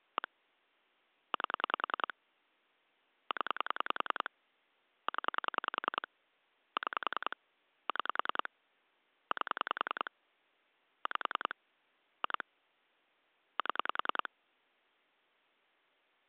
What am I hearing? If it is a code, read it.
Pulse dialling, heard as clicks on a phone line, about 10 pulses a second. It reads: 1 8 0 0 6 6 8 5 2 7